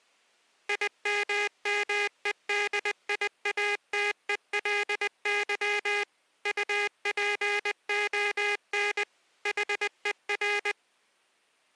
Morse code, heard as a buzzer, machine-sent, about 20 wpm. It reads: IMMEDIATELY UPON HER